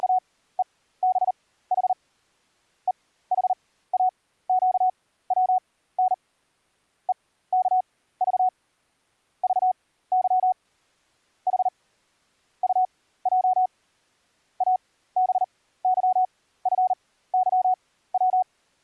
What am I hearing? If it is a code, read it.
Morse code, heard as a keyed tone, machine-sent, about 39 wpm, spaced as for 17 wpm, 740 Hz. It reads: … EHAQWN EKV VY H UJ ABYFYW